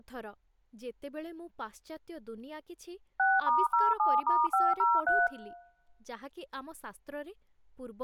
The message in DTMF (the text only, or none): 6*07*503